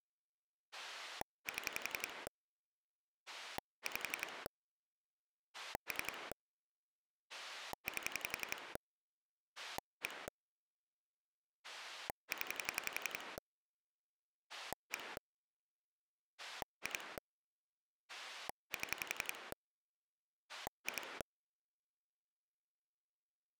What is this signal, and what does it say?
Pulse dialling, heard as a rotary dial, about 11 pulses a second. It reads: 7 5 3 8 1 0 1 2 7 2